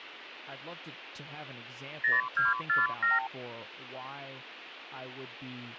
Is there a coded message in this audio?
Yes: multi-frequency trunk signalling (R2, with the far end's replies) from 2.0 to 3.3 s, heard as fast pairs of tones, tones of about 160 ms, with speech in English. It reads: 0247